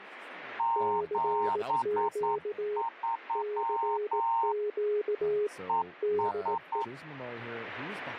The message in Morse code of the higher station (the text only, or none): 73 ES